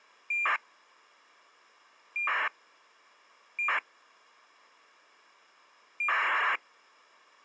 ACARS aircraft data, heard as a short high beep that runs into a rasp, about 2400 baud.